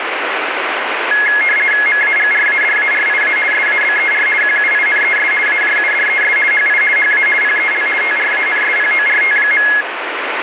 RTTY (50 baud, 450 Hz shift), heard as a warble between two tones, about 1900 Hz centre, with radio static. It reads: MAGRADARIA SABER QUINES AJUDES HI HA PEL TRANSPORT.